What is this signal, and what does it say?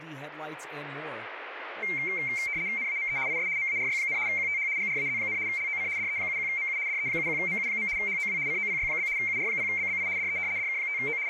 RTTY (75 baud, 170 Hz shift), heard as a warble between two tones, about 2200 Hz centre, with radio static and speech in English. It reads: NAME IS MARY, QTH GRAZ, LOC DE71MU DE71MU. HOW COPY? UR0BBI DE DK5O …